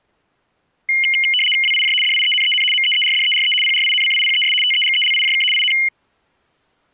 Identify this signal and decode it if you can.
RTTY (75 baud, 850 Hz shift), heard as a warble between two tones, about 2550 Hz centre. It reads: WIJ DIENEN MEERDERE PRINCIPES TEGELIJK IN